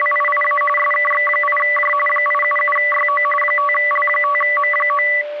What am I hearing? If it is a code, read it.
RTTY (45.45 baud, 850 Hz shift), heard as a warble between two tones, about 1550 Hz centre, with a steady whistle near 590 Hz. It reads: … SKX8J 877YO 5L5M9